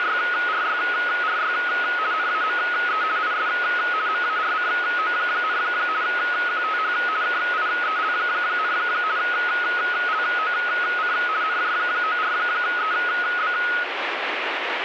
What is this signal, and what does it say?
RTTY (50 baud, 170 Hz shift), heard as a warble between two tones, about 1360 Hz centre, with radio static. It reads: … NAME IS MARCO, QTH KIEL, LOC NJ94EB